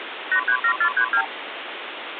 Multi-frequency trunk signalling (R2, with the far end's replies), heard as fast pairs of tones, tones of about 80 ms, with phone line noise. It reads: 837432